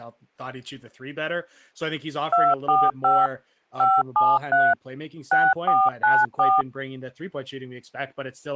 DTMF, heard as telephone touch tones, dialled by machine, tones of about 220 ms, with speech in English. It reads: 245 573 6494